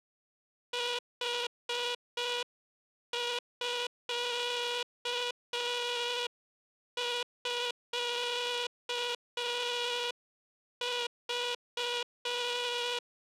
Morse code (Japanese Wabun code), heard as a buzzer, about 5 wpm. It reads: ヌミミク